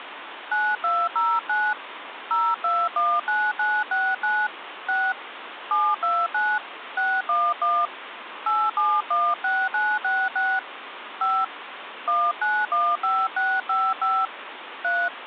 DTMF, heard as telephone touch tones, dialled by hand, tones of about 240 ms, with phone line noise. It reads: 9209 0219969 6 729 611 8716966 5 1915655 3